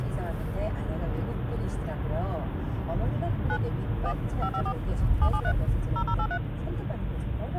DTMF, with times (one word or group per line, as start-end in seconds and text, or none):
3.5-3.6 9
4.1-4.1 1
4.4-4.7 554
5.2-5.5 773
6.0-6.4 0083